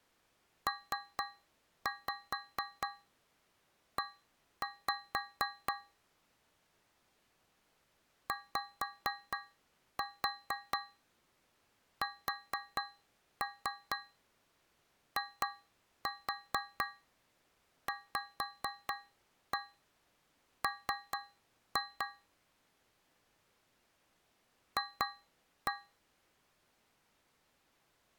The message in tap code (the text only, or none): PE YSIVM F